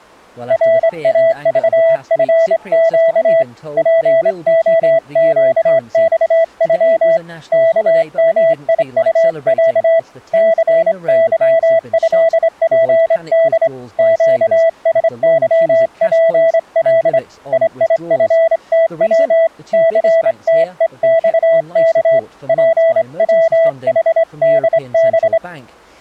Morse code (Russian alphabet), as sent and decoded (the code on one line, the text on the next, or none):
.-. .- ...- ..-. --.- / .--. --- --.- -..- ..-- / -.- -- .. ..- .-.- / -.-. -.-- ..-.. .--. -.. / --.- ... -.-- .--. .-.. / .. .. ..-. - .-- / -.-. - . -..- -.- / .--. .-- .... -.. -...
РАЖФЩ ПОЩЬЮ КМИУЯ ЦЫЭПД ЩСЫПЛ ИИФТВ ЦТЕЬК ПВХДБ